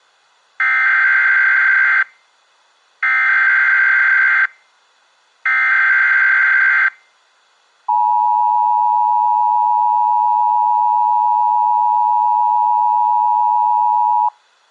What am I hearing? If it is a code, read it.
Emergency Alert System (SAME) tones (header bursts, then the 853 and 960 Hz attention tone), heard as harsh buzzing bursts, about 520.83 baud.